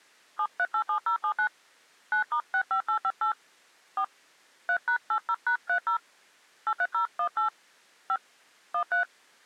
DTMF, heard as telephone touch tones, dialled by hand, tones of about 80 ms. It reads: 7387079 9*65858 4 3#80#30 83018 5 13